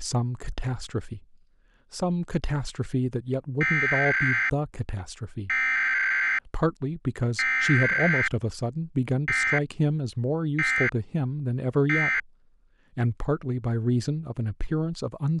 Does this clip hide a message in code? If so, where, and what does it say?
Yes: Emergency Alert System (SAME) tones (header bursts, then end-of-message bursts) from 3.6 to 12.2 s, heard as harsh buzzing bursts, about 520.83 baud, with speech in English.